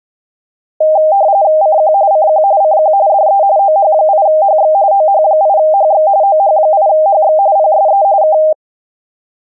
RTTY (45.45 baud, 170 Hz shift), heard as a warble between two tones, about 710 Hz centre. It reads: CQ CQ CQ DE OH8HX OH8HX OH8HX PSE K